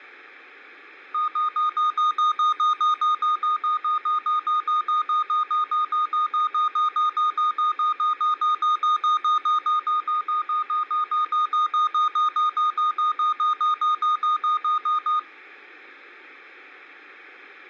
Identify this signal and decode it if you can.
Evenly repeated beeps. There is no code.